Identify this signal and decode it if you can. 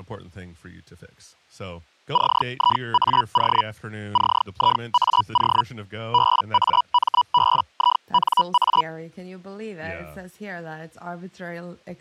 Hellschreiber (Feld-Hell, 122.5 baud), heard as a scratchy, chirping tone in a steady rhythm, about 980 Hz, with speech in English. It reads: CIAO CIAO BAMBINA